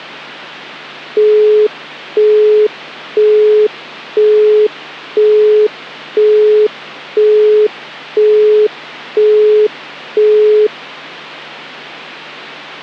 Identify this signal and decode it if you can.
Telephone call progress tone (single-tone plan, as in Europe, Japan and elsewhere), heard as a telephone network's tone, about 420 Hz, 0.5 s on and 0.5 s off, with hum. Busy tone.